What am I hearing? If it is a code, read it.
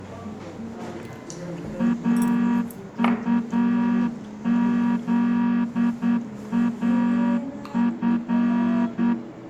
Morse code, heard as a horn, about 9 wpm, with room echo and the noise of a restaurant. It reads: AUZAF